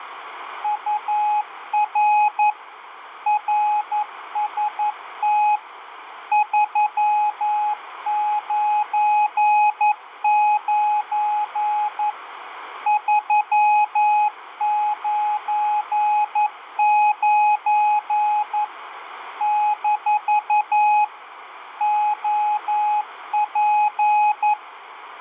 Morse code, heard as a keyed tone, machine-sent, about 11 wpm, 840 Hz, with radio static and a narrow filter. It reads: UR RST 399 399 - OP